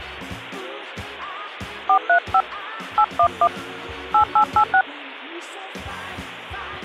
DTMF, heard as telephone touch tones, dialled by hand, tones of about 80 ms. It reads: 435 811 8886